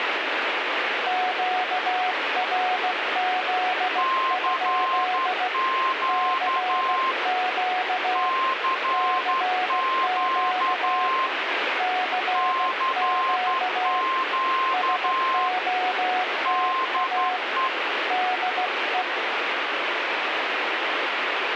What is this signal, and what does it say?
Morse code, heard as two keyed tones, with radio static. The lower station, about 16 wpm, 740 Hz: QRZ? CQ CQ CQ SOTA DE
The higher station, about 11 wpm, 1050 Hz: CQ CQ CQ DE